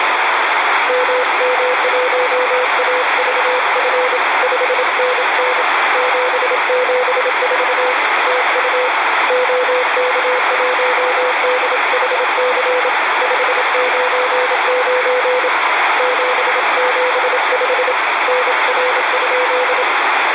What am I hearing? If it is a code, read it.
Morse code, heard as a keyed tone, hand-sent with a paddle, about 27 wpm, 500 Hz, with heavy radio static. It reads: MM1AVF 5NN 774 TU OK1DHC 599 775 NR?